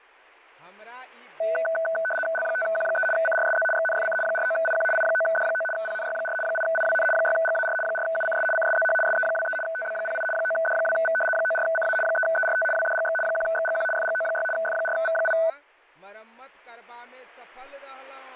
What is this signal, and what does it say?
RTTY (75 baud, 850 Hz shift), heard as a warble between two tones, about 1080 Hz centre, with speech in Maithili. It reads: L5Q3 CRSZ XNFC 49IQ I9D9 PNY4 8IWN 6GAR 4UCS CSZH SE23 TB08 9D2V 94CA 3ERT WDGX 1XGQ FGO6 F4V8